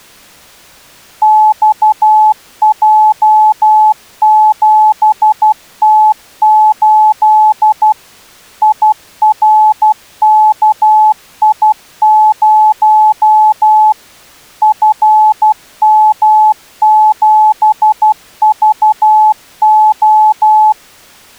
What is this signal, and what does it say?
Morse code, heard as a keyed tone, machine-sent, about 12 wpm, 860 Hz. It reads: XJ7T8 IRKI0 FM7VO